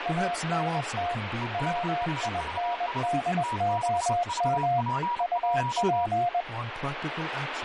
Morse code, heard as two keyed tones, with radio static and speech in English. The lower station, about 21 wpm, 700 Hz: ANT WINDOM UP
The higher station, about 30 wpm, 960 Hz: EDHVS T6VP1